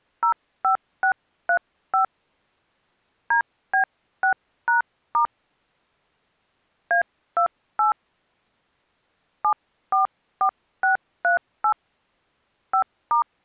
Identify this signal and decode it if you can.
DTMF, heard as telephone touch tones, dialled by hand, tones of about 110 ms. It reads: 05635 DB6#* A28 744638 5*